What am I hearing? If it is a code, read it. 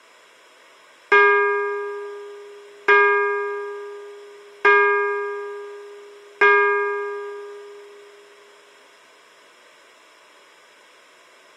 Clock strike, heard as a bell. 4. Four o'clock.